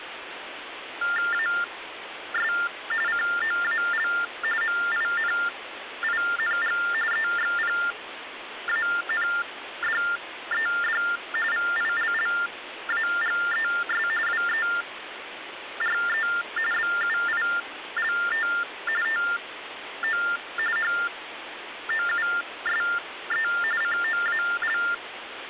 TTY/TDD text telephone tones (45.45 baud Baudot), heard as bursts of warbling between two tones, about 400 Hz shift, 1600 Hz centre, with phone line noise. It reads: AS COAL MINING EXPANDED VILLAGES WERE BUILT TO HOUSE COAL